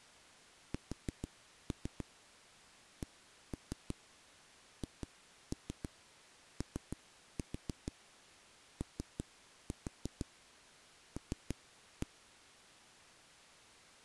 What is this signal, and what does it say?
Tap code, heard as knocks on a wall, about 6 knocks a second. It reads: SCHOOL